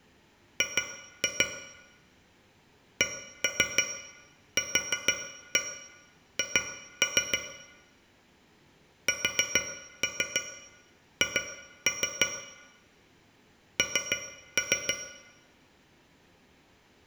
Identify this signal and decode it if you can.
Tap code, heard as taps on a metal pipe, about 6 knocks a second, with room echo. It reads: G CQH SH N